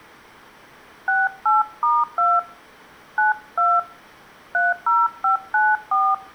DTMF, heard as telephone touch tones, dialled by hand, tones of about 180 ms. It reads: 68*2 92 30594